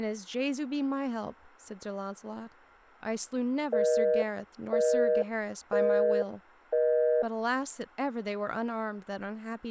Telephone call progress tone (North American plan), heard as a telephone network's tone, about 480, 620 Hz, 0.5 s on and 0.5 s off, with speech in English. Busy tone.